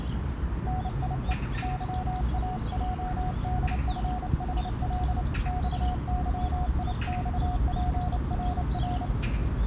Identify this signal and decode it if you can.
Morse code, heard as a keyed tone, hand-sent with a paddle, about 29 wpm, 730 Hz, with the noise of a park. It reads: NIE YAJDFHL XYIXPRR